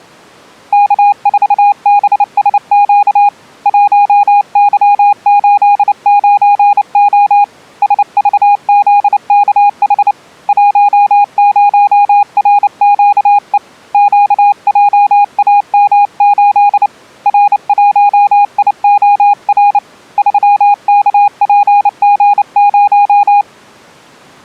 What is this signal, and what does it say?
Morse code, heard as a keyed tone, hand-sent with a paddle, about 29 wpm, 820 Hz. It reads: K4BSQ 1Y89O SVZKH 10RQE QJAM8 R1IOR 3KPG0